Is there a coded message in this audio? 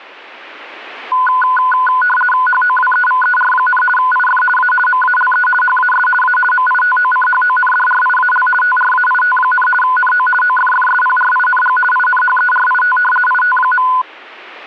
Yes: RTTY (50 baud, 450 Hz shift) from 1.1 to 14.0 s, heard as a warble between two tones, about 1240 Hz centre. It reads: HOWEVER, IF A MALE HAS A MITOCHONDRIAL TRAIT, NO OFFSPRING INHERIT IT.